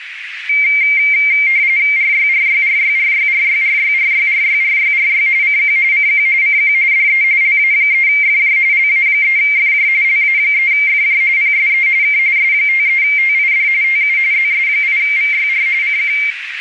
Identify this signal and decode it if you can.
RTTY (45.45 baud, 170 Hz shift), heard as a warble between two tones, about 2200 Hz centre, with radio static and a narrow filter. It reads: RYRYRYRYRYRYRYRYRYRY CQ CQ CQ DE LA3FJ LA3FJ LA3FJ PSE K S53TID TU ZS8VYR CQ